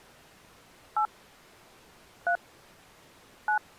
DTMF, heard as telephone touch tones, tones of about 90 ms. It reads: 8 3 9